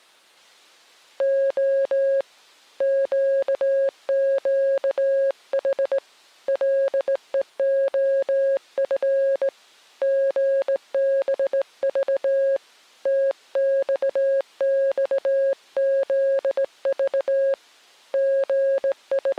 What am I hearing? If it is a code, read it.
Morse code, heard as a keyed tone, hand-sent with a straight key, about 18 wpm, 540 Hz. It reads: O QQH LEOF GBV TXXZV …